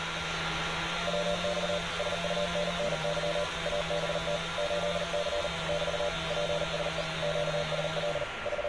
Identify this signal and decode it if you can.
Morse code, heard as a keyed tone, machine-sent, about 39 wpm, 590 Hz, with radio static, a steady whistle near 1380 Hz and street noise. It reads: WX SUNNY ABT 8C <BT> PSE QSL …